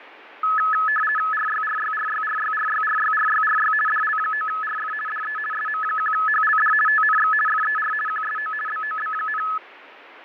RTTY (50 baud, 450 Hz shift), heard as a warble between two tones, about 1500 Hz centre, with radio static and fading. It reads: RYRYRYRYRYRYRYRY DL9RF DE SM1HLD TNX FER QSO BOB,